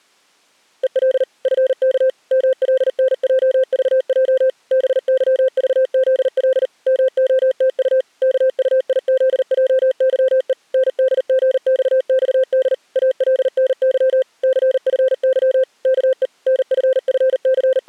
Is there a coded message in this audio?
Yes: Morse code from 0.8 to 17.9 s, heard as a keyed tone, machine-sent, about 39 wpm, 520 Hz. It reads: EL FK MLNJVJ BYVZL MOTU KUIZJYE NDGXXD ALNY CFY KE …